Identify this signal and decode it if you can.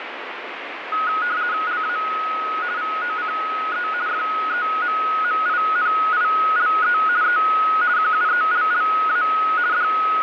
RTTY (50 baud, 170 Hz shift), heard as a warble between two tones, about 1360 Hz centre, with radio static. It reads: LA VOCE FEMMINILE E QUELLA …